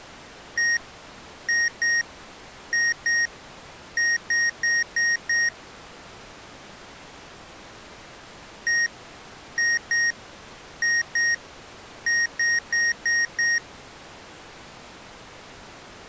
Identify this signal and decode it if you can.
Beep code, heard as beeps from a small speaker, played twice, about 1850 Hz. 1-2-2-5.